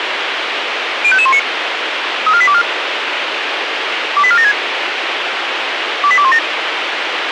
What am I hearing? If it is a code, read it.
Five-tone selective call (ZVEI), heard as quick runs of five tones, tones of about 70 ms, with radio hiss. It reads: 05519 34824 28476 28217